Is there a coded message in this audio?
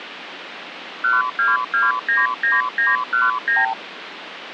Yes: multi-frequency trunk signalling (R2, with the far end's replies) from 1.0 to 3.7 s, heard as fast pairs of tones, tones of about 170 ms, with phone line noise. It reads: 12299919